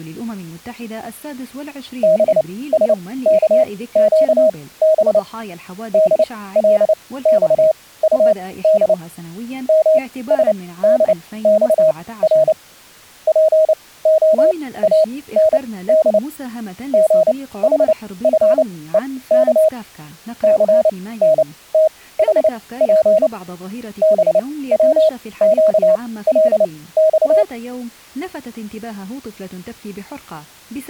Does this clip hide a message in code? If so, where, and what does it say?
Yes: Morse code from 2.0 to 27.5 s, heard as a keyed tone, machine-sent, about 29 wpm, spaced as for 18 wpm, 630 Hz, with speech in Arabic. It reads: BSKQB DLXUD MSDXR POAND GHFEK CNTHP BWQLX